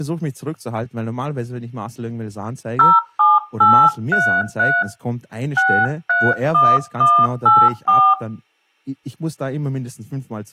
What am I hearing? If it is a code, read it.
DTMF, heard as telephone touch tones, dialled by hand, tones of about 240 ms, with speech in German. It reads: 07833 631184